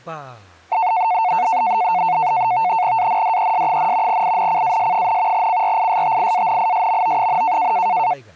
NAVTEX (SITOR-B), 100 baud, 170 Hz shift, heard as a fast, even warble, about 810 Hz centre, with speech in Bodo. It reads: ANDES, INCAS, CRISTIANISMO,